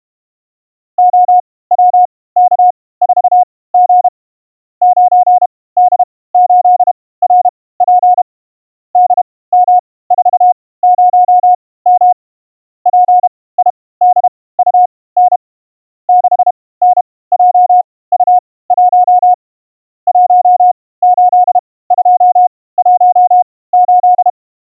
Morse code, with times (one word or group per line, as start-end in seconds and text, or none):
1.0-4.1 OWK4G
4.8-8.2 9D8RP
9.0-12.1 DM40M
12.9-15.4 PIDUN
16.1-19.3 6NJU1
20.1-24.3 18218